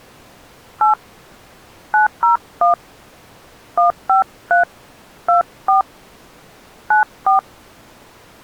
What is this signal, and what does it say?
DTMF, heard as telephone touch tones, dialled by hand, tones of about 130 ms. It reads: 8 901 153 24 94